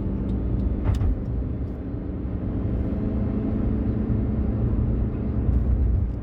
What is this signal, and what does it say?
The noise inside a car. There is no code.